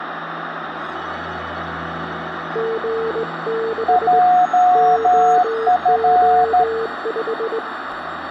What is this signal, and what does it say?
Morse code, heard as two keyed tones, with radio static. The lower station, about 19 wpm, 450 Hz: G6 OO5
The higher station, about 13 wpm, 720 Hz: JF